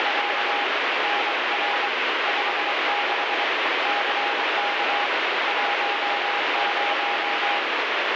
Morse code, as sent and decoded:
… / -. .-. / ..... -.... / -.-. -.- / .---- -----
… NR 56 CK 10

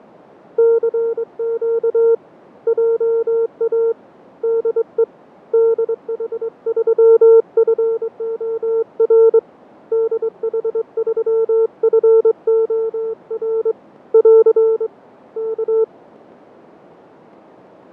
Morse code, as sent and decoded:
-.-. --.- / .--- .- / -.. . / -.. .... ...-- ..-. --- .-. / -.. .... ...-- ..-. --- .-. / .-.-. / -.-
CQ JA DE DH3FOR DH3FOR <AR> K

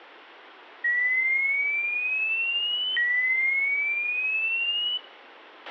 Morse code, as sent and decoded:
none

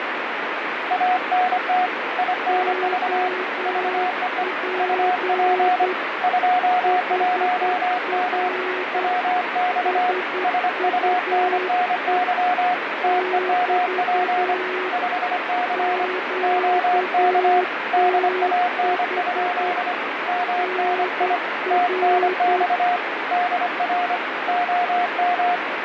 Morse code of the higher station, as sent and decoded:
.- -. - / .. -. ...- / ...- . . / ..- .--. / ..--- .---- -- / .-- -..- / ... ..- -. -. -.-- / - . -- .--. / ..... -.-. / --- -.- / -.. .- -. ..--.. / -- -. .. / - -. -..- / -.. .-. / --- --
ANT INV VEE UP 21M WX SUNNY TEMP 5C OK DAN? MNI TNX DR OM

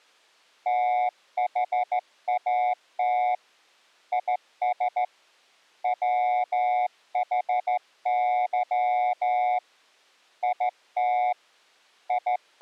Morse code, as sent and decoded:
- .... .- - / .. ... / .-- .... -.-- / .. - / …
THAT IS WHY IT …

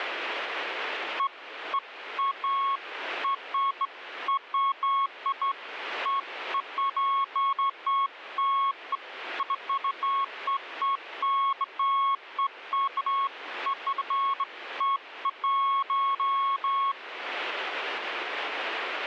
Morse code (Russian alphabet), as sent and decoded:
none

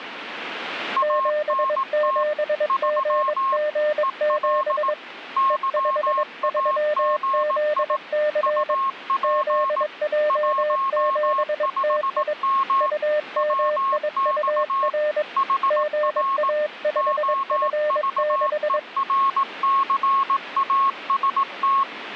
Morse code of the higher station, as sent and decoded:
.- -. - / ...-- / . .-.. / -.-- .- --. .. / ..- .--. / .---- ..... -- / .-- -..- / .... .-. / --- ...- . .-. -.-. .- ... -
ANT 3 EL YAGI UP 15M WX HR OVERCAST

